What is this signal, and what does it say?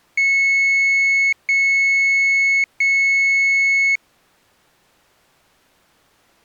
Beep code, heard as a piezo beeper, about 2200 Hz. 3 long. In IBM BIOS tables: keyboard card error.